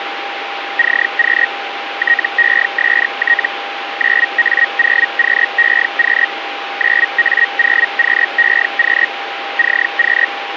Hellschreiber (Feld-Hell, 122.5 baud), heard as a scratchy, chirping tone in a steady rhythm, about 1900 Hz, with radio static and a steady whistle near 800 Hz. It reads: CQ TEST 9A0QEQ 9A0QEQ CQ